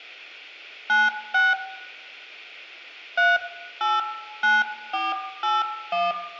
DTMF, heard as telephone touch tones, dialled by hand, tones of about 190 ms, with room echo. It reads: 96 389481